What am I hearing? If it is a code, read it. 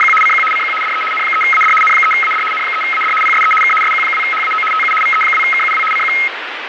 RTTY (75 baud, 850 Hz shift), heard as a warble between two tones, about 1700 Hz centre, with radio static and fading. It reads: … CQ CQ DE N3AD N3AD N3AD PSE K SQ2HAO TU VE2KUW CQ